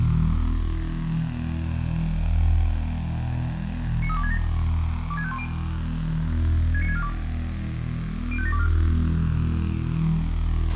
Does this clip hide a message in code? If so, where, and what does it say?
Yes: five-tone selective call (ZVEI) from 4.0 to 8.7 s, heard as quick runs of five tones, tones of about 70 ms, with radio hiss, a squelch burst at the end and room echo. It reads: 93267 26510 69642 05724